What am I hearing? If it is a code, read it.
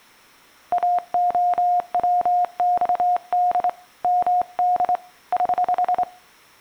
Morse code, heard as a keyed tone, hand-sent with a straight key, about 26 wpm, 720 Hz. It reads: AOWXD MD <HH>